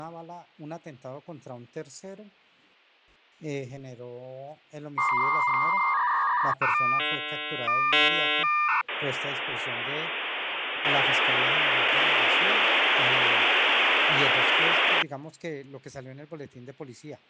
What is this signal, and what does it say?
Dial-up modem handshake (V.34 or later), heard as a whistle, warbles, then hiss.